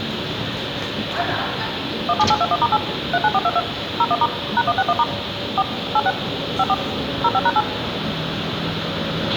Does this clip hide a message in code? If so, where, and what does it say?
Yes: DTMF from 2.1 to 7.6 s, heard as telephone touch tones, dialled by machine, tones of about 50 ms, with radio hiss, a squelch burst at the end, room echo and the noise of a residential street. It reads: 17821*8 39422 01* #161* 4 86 54 05#8